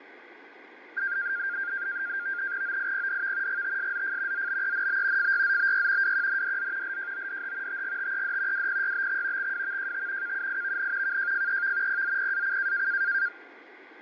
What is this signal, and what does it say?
NAVTEX (SITOR-B), 100 baud, 170 Hz shift, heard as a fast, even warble, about 1500 Hz centre, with radio static and fading. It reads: OIPDV GTSZF ZBENB FYZBY WQNDZ LJODH TGTED WPYBX XWVJT KUIVN KJFEV PZPAC